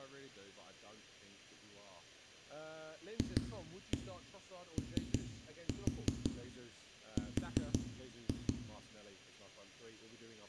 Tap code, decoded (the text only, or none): FOR